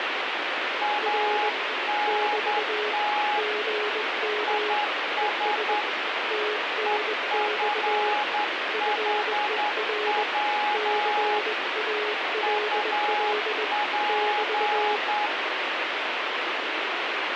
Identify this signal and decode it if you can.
Morse code, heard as two keyed tones, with heavy radio static. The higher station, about 10 wpm, 840 Hz: ANT IS EFHW UP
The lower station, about 20 wpm, 420 Hz: R <BT> GM ES TNX FER CALL <BT>